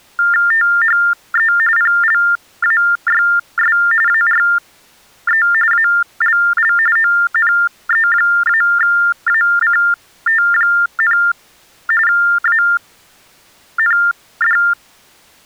TTY/TDD text telephone tones (45.45 baud Baudot), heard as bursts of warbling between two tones, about 400 Hz shift, 1600 Hz centre. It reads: THE PLAYS ARE ALL ONE-ACT, AND